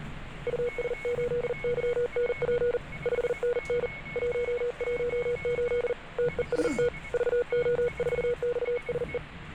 Morse code, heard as a keyed tone, hand-sent with a paddle, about 40 wpm, 480 Hz, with a weaker station near 2200 Hz and the noise inside a subway train. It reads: US8YNP 5NN 118 TEST VO4XSE